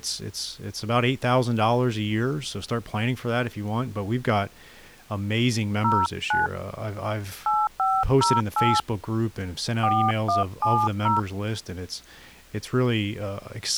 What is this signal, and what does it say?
DTMF, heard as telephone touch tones, dialled by hand, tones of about 230 ms, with speech in English. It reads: 09 8508 4170